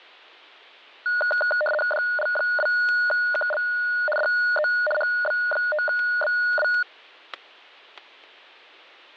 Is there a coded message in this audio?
Yes: RTTY (75 baud, 850 Hz shift) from 1.1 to 6.8 s, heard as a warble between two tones, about 1030 Hz centre, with static crashes. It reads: DL2KL DE HB5BW